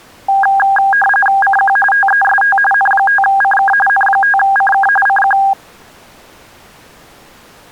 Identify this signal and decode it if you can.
RTTY (45.45 baud, 850 Hz shift), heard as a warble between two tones, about 1210 Hz centre. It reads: CQ TEST N5CK N5CK CQ